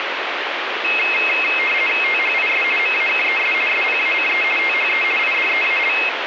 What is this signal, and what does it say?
RTTY (50 baud, 450 Hz shift), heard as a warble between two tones, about 2350 Hz centre, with radio static. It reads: THIS MAKES SPACE THE IDEAL